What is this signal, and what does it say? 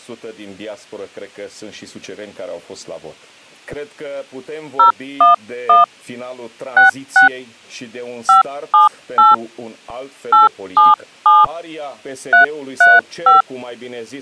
DTMF, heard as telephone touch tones, dialled by hand, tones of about 150 ms. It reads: 011 66 578 877 335